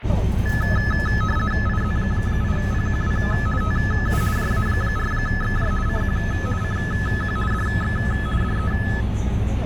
RTTY (50 baud, 450 Hz shift), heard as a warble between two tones, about 1500 Hz centre, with radio static and the noise inside a bus. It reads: IZ8PQW TU JA4XJ CQ CQ DX DE